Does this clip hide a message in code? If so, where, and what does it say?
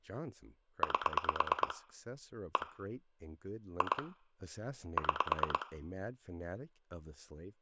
Yes: pulse dialling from 0.8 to 5.6 s, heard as clicks on a phone line, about 9 pulses a second, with room echo and speech in English. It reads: 8 1 2 6